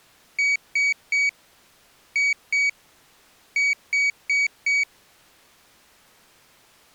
Beep code, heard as a piezo beeper, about 2250 Hz. 3-2-4. In Phoenix BIOS tables: keyboard controller failure.